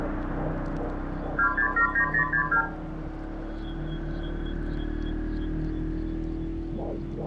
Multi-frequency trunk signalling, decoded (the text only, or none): 2679062